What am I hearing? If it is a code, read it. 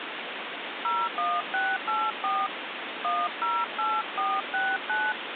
DTMF, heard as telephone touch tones, dialled by hand, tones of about 230 ms, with phone line noise. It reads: 01684 108469